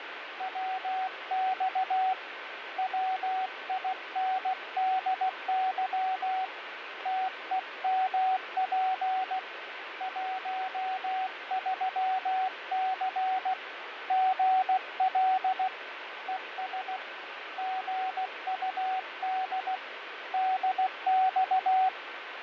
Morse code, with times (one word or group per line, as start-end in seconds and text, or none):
0.4-2.1 WX
2.8-6.5 WINDY
7.1-9.4 TEMP
10.0-13.5 13C
14.1-15.7 GL
16.3-17.0 ES
17.6-19.8 GUD
20.3-21.9 DX